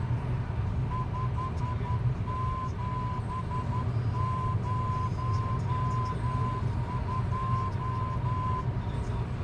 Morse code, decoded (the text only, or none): 5702